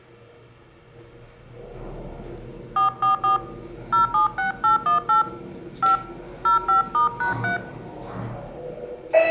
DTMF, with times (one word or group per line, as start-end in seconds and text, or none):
2.8-3.4 444
3.9-5.2 076818
5.8-6.0 5
6.5-7.6 05*#3